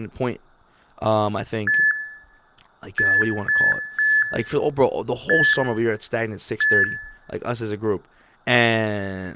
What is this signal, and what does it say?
Beep code, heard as beeps from a small speaker, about 1750 Hz, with room echo and speech in English. 1-3-1-1. In Phoenix BIOS tables: memory refresh test failure.